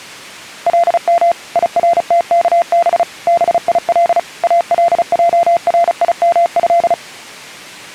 Morse code (Arabic alphabet), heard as a keyed tone, machine-sent, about 35 wpm, 690 Hz. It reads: لم يرتكب بيل الجريمه